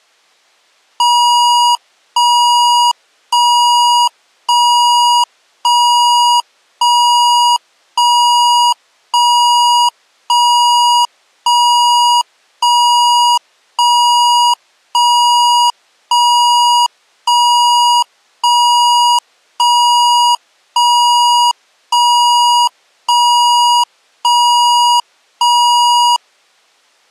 Evenly repeated beeps. There is no code.